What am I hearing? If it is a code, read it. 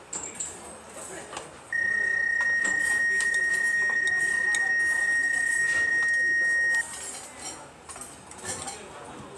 PSK31 (31.25 baud), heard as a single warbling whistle, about 1850 Hz, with the noise of a restaurant.